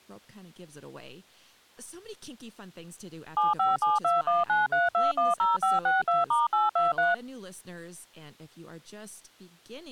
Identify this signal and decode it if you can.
DTMF, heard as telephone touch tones, dialled by machine, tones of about 170 ms, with speech in English. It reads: 7572193210562*823